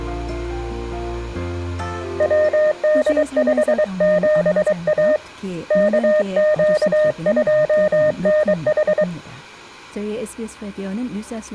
Morse code, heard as a keyed tone, hand-sent with a paddle, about 23 wpm, 610 Hz, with room echo. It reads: WD57A KQ2NH